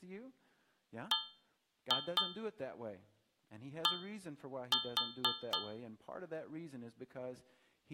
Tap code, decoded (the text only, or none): BD